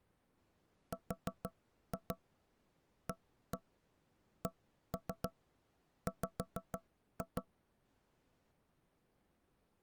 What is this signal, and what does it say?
Tap code, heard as knocks on wood, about 6 knocks a second. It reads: RACW